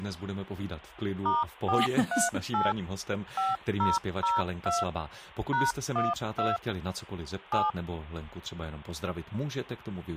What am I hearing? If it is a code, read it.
DTMF, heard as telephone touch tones, dialled by machine, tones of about 180 ms, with hum and speech in Czech. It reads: *438 5002 #12 7